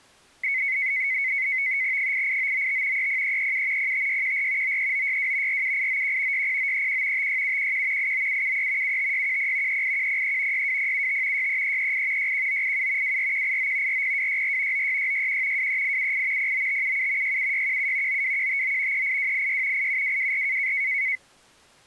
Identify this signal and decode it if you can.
NAVTEX (SITOR-B), 100 baud, 170 Hz shift, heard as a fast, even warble, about 2150 Hz centre. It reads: 88995 30337 05614 93962 47891 60931 56711 89773 75610 38103 62075 63338 61987 24189 40264 96661 23878 09577 67617 92159 38286 87224